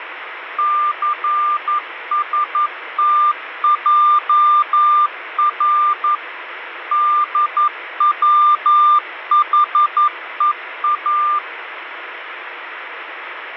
Morse code, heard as a keyed tone, machine-sent, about 11 wpm, 1190 Hz, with radio static. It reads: CSTJR DWHEA